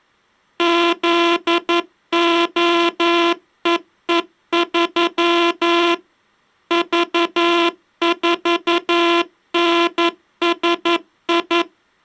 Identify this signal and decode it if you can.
Morse code, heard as a buzzer, machine-sent, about 11 wpm. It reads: ZOEE3 V4NSI